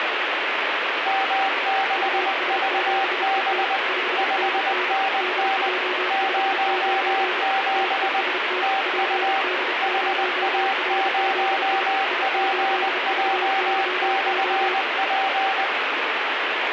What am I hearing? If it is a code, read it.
Morse code, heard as two keyed tones, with heavy radio static. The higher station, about 20 wpm, 780 Hz: M6VB 5NN 07 TU HA0PJ/P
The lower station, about 31 wpm, 370 Hz: US7ET 5NN DJ59 TEST PD0RZI I8VYO